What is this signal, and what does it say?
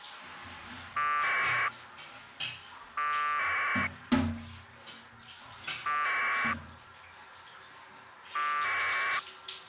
Packet radio (AX.25, as in APRS), 1200 baud, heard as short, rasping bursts, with the noise of a restroom.